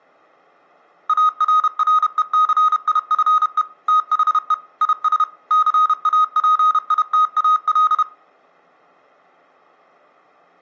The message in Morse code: ARRECIFE THE IS CAPITAL

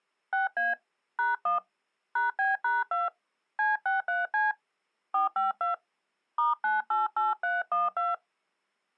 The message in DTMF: 6A #1 #B#2 C63C 452 *988312

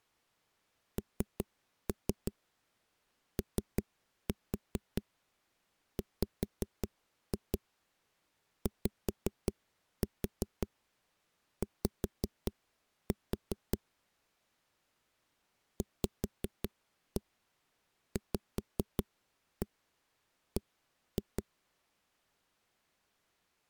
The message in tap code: NOWYY VVB

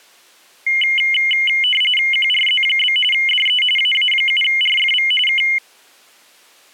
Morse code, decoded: none

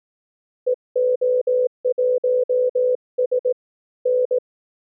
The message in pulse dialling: none

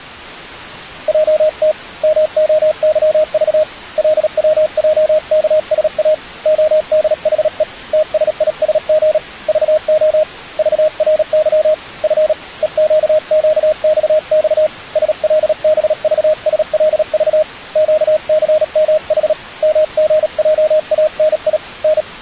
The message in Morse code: JT MOYV LWJKSA ODHE TSISG VO VRY F EQQXX SLBVSLV QCMH MGJANI N

